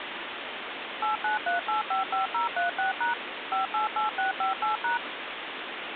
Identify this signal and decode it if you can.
DTMF, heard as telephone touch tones, dialled by machine, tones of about 130 ms, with phone line noise. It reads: 893855036# 588658#